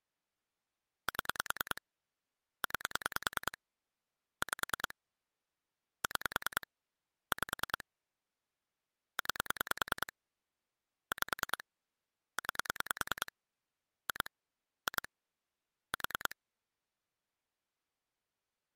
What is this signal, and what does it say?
Pulse dialling, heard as clicks on a phone line, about 10 pulses a second. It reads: 7 9 5 6 5 9 5 9 2 2 4